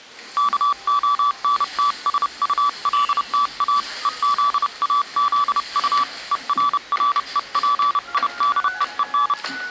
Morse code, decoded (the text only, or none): KONTSULTA EZAZU ERREPIDEEN